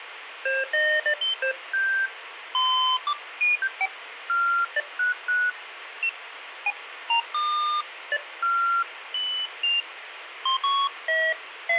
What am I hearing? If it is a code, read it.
Electronic bleeps of random pitch and length, with radio static. There is no code.